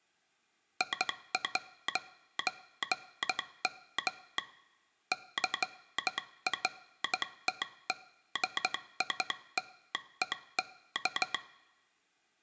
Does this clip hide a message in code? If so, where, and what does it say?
Yes: Morse code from 0.7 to 11.4 s, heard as a telegraph sounder, hand-sent with a straight key, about 13 wpm, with room echo. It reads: I'M CREDITED